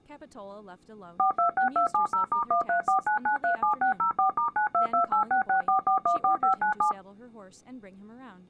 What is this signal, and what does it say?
DTMF, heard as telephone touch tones, dialled by machine, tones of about 110 ms, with speech in English. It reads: 426270*1349937604*9228664414597